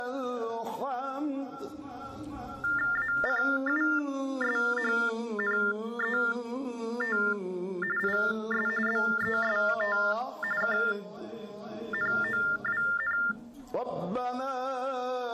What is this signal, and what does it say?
TTY/TDD text telephone tones (45.45 baud Baudot), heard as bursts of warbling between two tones, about 400 Hz shift, 1600 Hz centre. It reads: ACUSHNET IS BEST KNOWN